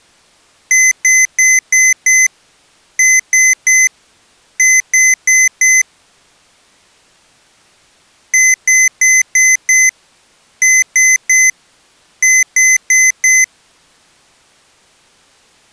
Beep code, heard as beeps from a small speaker, played twice, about 2050 Hz. 5-3-4.